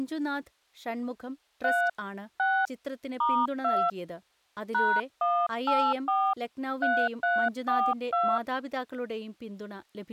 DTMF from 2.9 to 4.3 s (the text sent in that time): *2